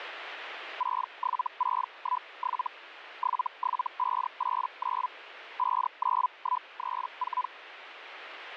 Hellschreiber (Feld-Hell, 122.5 baud), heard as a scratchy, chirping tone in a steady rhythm, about 1000 Hz, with radio static. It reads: 67617 77589 59134